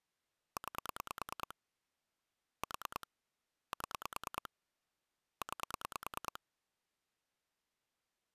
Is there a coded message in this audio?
Yes: pulse dialling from 0.6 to 6.4 s, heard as clicks on a phone line, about 9 pulses a second. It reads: 9 4 7 9